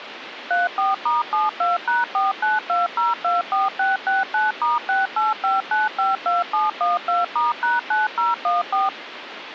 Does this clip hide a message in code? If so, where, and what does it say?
Yes: DTMF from 0.5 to 8.9 s, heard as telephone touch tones, dialled by machine, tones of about 170 ms, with phone line noise. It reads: 34*72#492024669*685952712*#9014